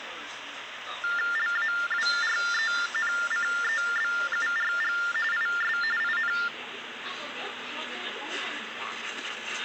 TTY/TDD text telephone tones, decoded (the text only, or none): LAWRENCEBURG IS IN